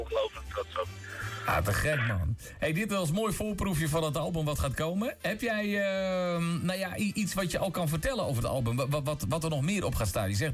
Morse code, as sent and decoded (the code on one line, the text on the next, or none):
none